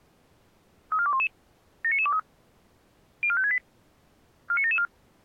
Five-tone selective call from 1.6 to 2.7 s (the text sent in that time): 79923